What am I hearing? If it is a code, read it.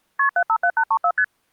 Multi-frequency trunk signalling (R1, as on North American trunks), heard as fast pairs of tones, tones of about 70 ms. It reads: KP 757834 ST